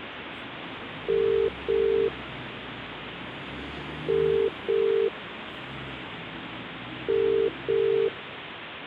Telephone call progress tone (as in the UK, Ireland, Australia and similar networks), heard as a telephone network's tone, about 400, 450 Hz, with phone line noise and street noise. Ringback tone.